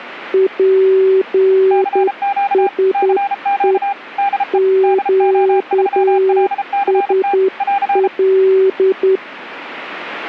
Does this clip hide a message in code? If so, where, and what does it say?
Yes: Morse code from 0.3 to 9.2 s, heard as two keyed tones. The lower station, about 10 wpm, 380 Hz: PSE QSL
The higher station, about 33 wpm, 800 Hz: CQ CQ DE DO3LCT <AR>